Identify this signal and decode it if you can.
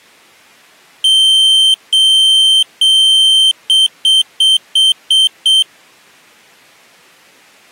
Beep code, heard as a piezo beeper, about 3100 Hz. 3 long, 6 short.